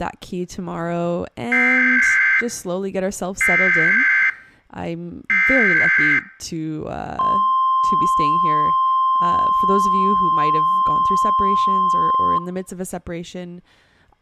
Emergency Alert System (SAME) tones (header bursts, then the 1050 Hz attention tone), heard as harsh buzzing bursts, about 520.83 baud, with speech in English.